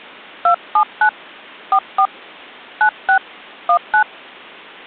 DTMF, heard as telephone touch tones, dialled by hand, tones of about 90 ms. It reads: 279 44 96 19